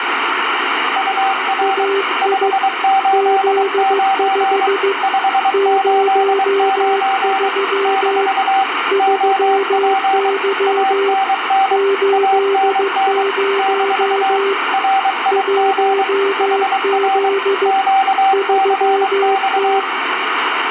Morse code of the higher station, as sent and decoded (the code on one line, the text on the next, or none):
..- .-. / ..... ---.. ----. / ..... ---.. ----. / -....- / --- .--. / .- -. -. / .- -. -. / -....- / .-. .. --. / .... .-. / --.- -.-. -..-
UR 589 589 - OP ANN ANN - RIG HR QCX